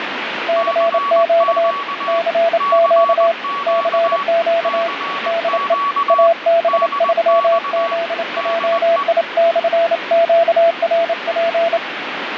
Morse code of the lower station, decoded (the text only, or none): CQ CQ CQ DE AB3ZJI/QRP